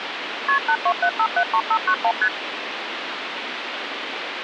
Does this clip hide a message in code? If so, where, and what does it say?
Yes: multi-frequency trunk signalling (R1, as on North American trunks) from 0.5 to 2.3 s, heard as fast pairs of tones, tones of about 70 ms, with phone line noise. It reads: KP 827573591 ST